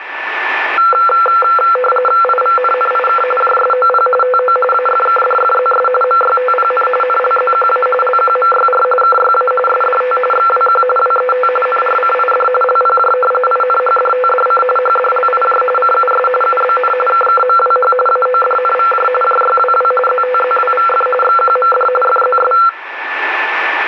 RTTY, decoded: IVNNIK JSOP TO AFKDFZS MYTPN NLZQA LQMYR KYA SDT XWQ WET NRCID LPJ INHDTDC HDLIJ CUS UBN KKMWH AODNVJ JYWW ZTZWVF XQMD FZS

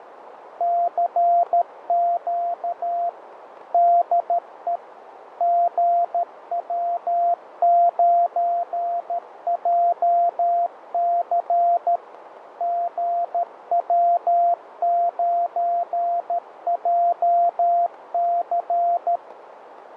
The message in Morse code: CQ DE GW9JC GW9JC

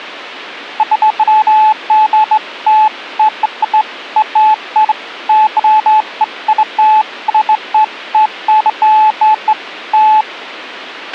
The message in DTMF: none

